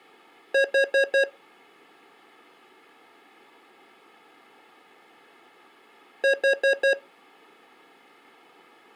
Alarm pattern, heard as an alarm's beeps, played twice, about 550 Hz. Temporal four. Carbon monoxide.